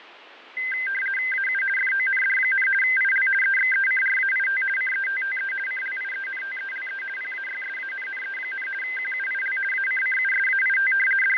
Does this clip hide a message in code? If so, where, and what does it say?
Yes: RTTY (50 baud, 450 Hz shift) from 0.6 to 11.4 s, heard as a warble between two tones, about 1800 Hz centre, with radio static and fading. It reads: AU FOND, IL EXECRAIT CETTE CLIENTELE PAYSANNE, QUIL ACCUSAIT …